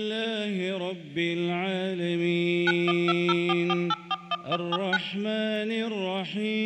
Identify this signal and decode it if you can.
DTMF, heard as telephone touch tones, dialled by machine, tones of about 40 ms. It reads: 912044841179